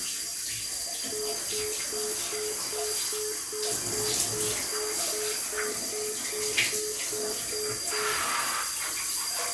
Telephone call progress tone (single-tone plan, as in most of Europe), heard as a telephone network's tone, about 420 Hz, 0.2 s on and 0.2 s off, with room echo and the noise of a restroom. Congestion tone.